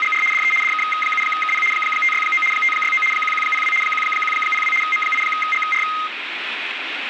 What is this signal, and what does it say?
RTTY (75 baud, 850 Hz shift), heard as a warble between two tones, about 1700 Hz centre, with radio static. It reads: … DE DK7KP 569 569 1102 1102 M8GR